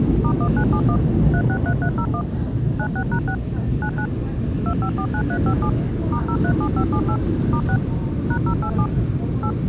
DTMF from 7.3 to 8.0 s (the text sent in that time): *6